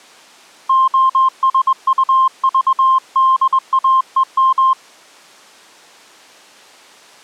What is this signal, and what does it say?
Morse code (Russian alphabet), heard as a keyed tone, hand-sent with a straight key, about 21 wpm, 1050 Hz. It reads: ОСУЖДАЕМ